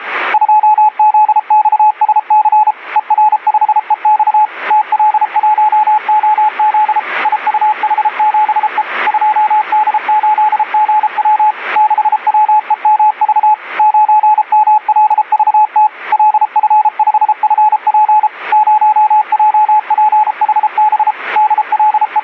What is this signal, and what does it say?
Morse code, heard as a keyed tone, machine-sent, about 33 wpm, 850 Hz. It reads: 2ZXSC ER5EX TL1OZ IUH7E 2D8GW 6WEMV 9MLVT LF5FP 0JPHB …